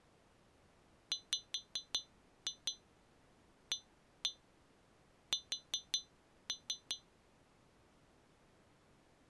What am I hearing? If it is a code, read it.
Tap code, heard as taps on glass, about 5 knocks a second. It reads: WAS